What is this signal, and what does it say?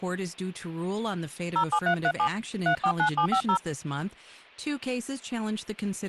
DTMF, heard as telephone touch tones, dialled by hand, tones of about 90 ms, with speech in English. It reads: 07337 349750